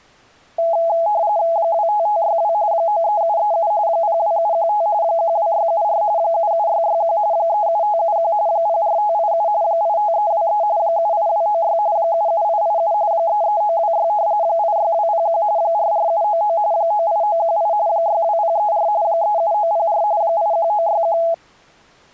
RTTY (45.45 baud, 170 Hz shift), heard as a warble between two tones, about 750 Hz centre. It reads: 25562 93737 02715 12674 77661 37571 04587 85323 78296 77887 33926 86201 44799 98918 62034 37904 81961